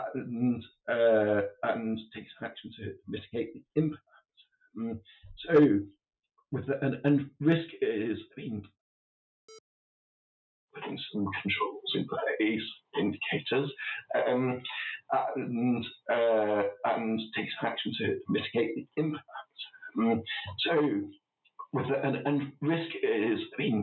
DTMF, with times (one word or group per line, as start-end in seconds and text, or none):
none